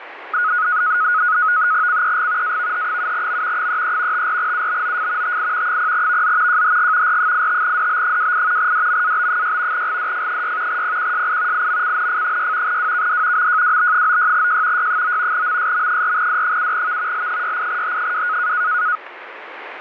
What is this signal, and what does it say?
NAVTEX (SITOR-B), 100 baud, 170 Hz shift, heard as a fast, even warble, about 1360 Hz centre, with radio static. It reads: CEG AVH7M 33 54UBOF TI 0VZ JHG R85DB28 DMAB6 GDF6 PQSI IMCNF6 WKD MJWB96J Y9 MSM4D7V L68H2